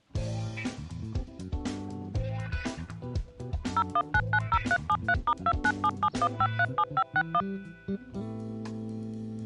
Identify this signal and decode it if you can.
DTMF, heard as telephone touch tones, dialled by machine, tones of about 60 ms. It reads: 01990373*29771537561